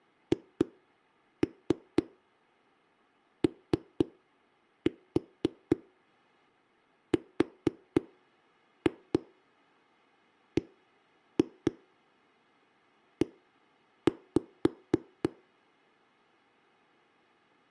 Tap code, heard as knocks on a wall, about 4 knocks a second. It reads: HORBE